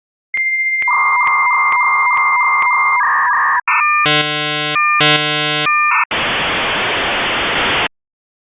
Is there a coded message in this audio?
Yes: dial-up modem handshake (V.34 or later) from 0.3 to 7.9 s, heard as a whistle, warbles, then hiss.